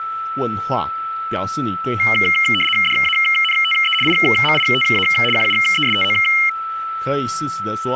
RTTY (75 baud, 850 Hz shift), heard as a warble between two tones, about 2550 Hz centre, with a steady whistle near 1320 Hz and speech in Chinese. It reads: DANTE IMITA QUESTO